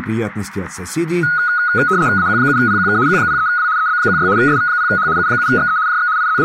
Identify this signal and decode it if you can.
RTTY (75 baud, 170 Hz shift), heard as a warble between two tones, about 1360 Hz centre, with radio static. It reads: AQ7PQK Q03W EB16 SV0H U7XE JX …